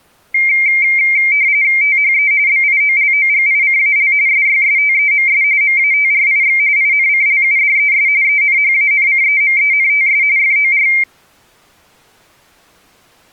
RTTY (45.45 baud, 170 Hz shift), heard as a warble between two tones, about 2200 Hz centre. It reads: THE BIOLOGICAL SYSTEMS MATRIX INCLUDES ENHANCEMENTS FOR